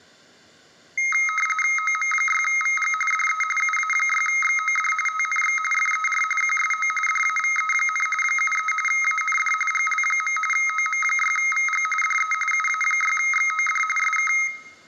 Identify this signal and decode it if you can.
RTTY (45.45 baud, 850 Hz shift), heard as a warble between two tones, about 1700 Hz centre, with room echo. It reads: OM6VG DE UA6XOD TNX FER QSO DAVE, 73 AND GL. OM6VG DE UA6XOD SK